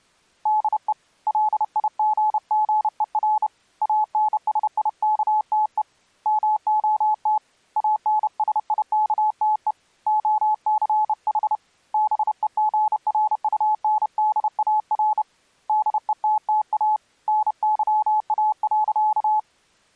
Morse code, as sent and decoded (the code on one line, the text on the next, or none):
-.. . / .-.. .. --. --. . .-. / .- -. ... .. -.- - . / -- --- - / .- -. ... .. -.- - . / --- -.-. .... / -... . --. .-. ..- -. -.. .- .-. / -.. . - - .- / -. -.-- .- .-.-.-
DE LIGGER ANSIKTE MOT ANSIKTE OCH BEGRUNDAR DETTA NYA.